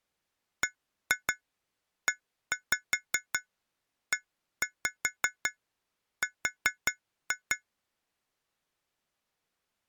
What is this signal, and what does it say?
Tap code, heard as taps on glass, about 5 knocks a second. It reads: BEER